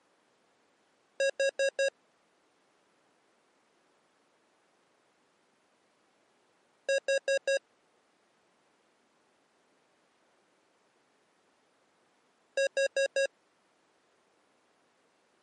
Alarm pattern, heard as an alarm's beeps, played three times, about 550 Hz. Temporal four. Carbon monoxide.